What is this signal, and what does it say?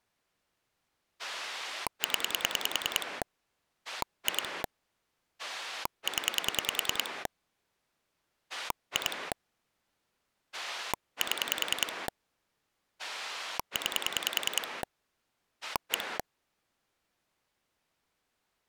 Pulse dialling, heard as a rotary dial, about 10 pulses a second. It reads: 0 2 0 2 7 9 1